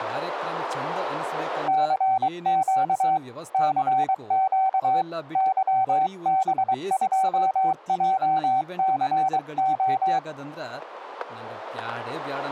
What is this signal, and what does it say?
Morse code, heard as a keyed tone, hand-sent with a paddle, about 23 wpm, 760 Hz, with static crashes and speech in Kannada. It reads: CQ CQ YB2JCO